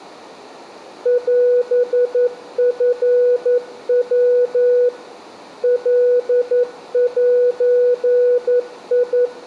Morse code (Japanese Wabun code), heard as a keyed tone, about 11 wpm, 490 Hz. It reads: オチヤ カゼ